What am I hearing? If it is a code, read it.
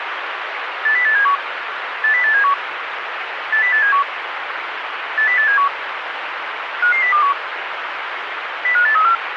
Five-tone selective call (CCIR), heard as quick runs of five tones, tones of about 100 ms, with radio hiss. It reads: 80871 80871 80871 80871 55021 05834